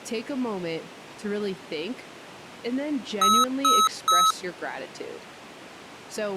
Beep code, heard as beeps from a small speaker, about 1290 Hz, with speech in English. 3 short. In AMI BIOS tables: failure in the first 64 KB of memory; in Dell tables: chipset error.